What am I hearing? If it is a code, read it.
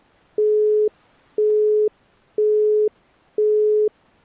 Telephone call progress tone (single-tone plan, as in Europe, Japan and elsewhere), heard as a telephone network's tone, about 420 Hz, 0.5 s on and 0.5 s off. Busy tone.